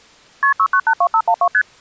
Multi-frequency trunk signalling (R1, as on North American trunks), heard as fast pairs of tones, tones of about 70 ms. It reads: KP 6982512 ST